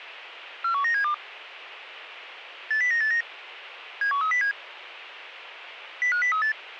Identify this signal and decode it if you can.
Five-tone selective call (CCIR), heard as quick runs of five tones, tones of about 100 ms, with radio hiss. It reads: 41972 80989 71307 05038